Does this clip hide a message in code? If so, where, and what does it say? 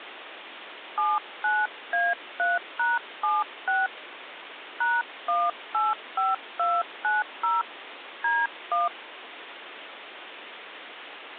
Yes: DTMF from 1.0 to 8.9 s, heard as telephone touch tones, dialled by hand, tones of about 190 ms, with phone line noise. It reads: 79A3#76 #185290 D1